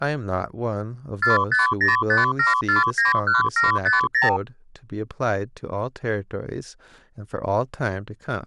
Multi-frequency trunk signalling (R2, with the far end's replies), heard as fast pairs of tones, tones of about 150 ms, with speech in English. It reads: 45057491750